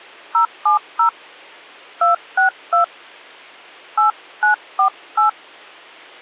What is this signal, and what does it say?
DTMF, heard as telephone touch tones, dialled by hand, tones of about 110 ms. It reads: 070 262 8948